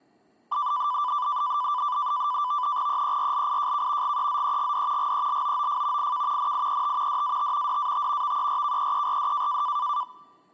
NAVTEX (SITOR-B), 100 baud, 170 Hz shift, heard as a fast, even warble, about 1090 Hz centre. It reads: EERLIJK GEZEGD GELOOF IK NIET DAT DAT VERKEERD